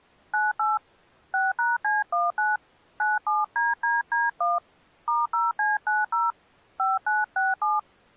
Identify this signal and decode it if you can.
DTMF, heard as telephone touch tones, dialled by hand, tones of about 180 ms. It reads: 98 6#C19 97DDD1 *0C90 5967